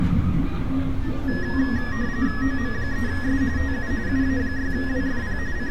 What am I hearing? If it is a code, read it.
RTTY (45.45 baud, 170 Hz shift), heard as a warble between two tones, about 1800 Hz centre, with street noise. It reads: OM3S TU UA6WFP …